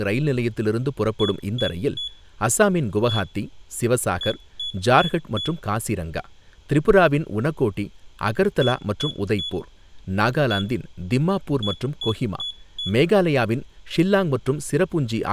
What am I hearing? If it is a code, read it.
Beep code, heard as a piezo beeper, played twice, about 3400 Hz, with room echo and speech in Tamil. 3-1-4. In Phoenix BIOS tables: interrupt mask register failure.